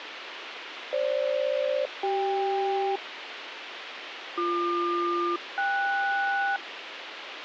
Aircraft SELCAL, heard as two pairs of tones, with radio hiss. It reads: FG-CK BQ-KS